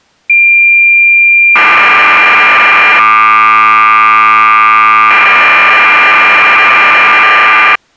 Cassette data (Kansas City type), 1200 baud, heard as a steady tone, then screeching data.